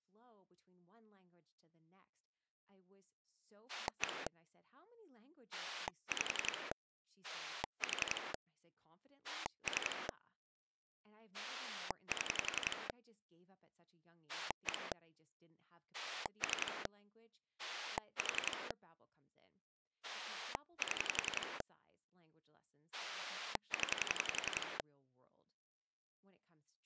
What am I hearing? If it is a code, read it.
Pulse dialling, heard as a rotary dial, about 11 pulses a second, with speech in English. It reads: 1 5 4 3 7 1 3 4 7 0